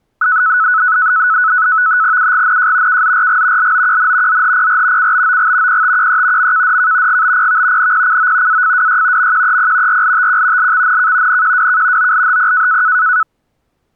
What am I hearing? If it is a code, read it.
NAVTEX (SITOR-B), 100 baud, 170 Hz shift, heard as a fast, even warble, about 1390 Hz centre. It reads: UGNJ KZRG LOQN ZHPR CBOG PTQE MKDK GBPV NPCO AFWY MQEP RLTQ LXNK NQWK OLHP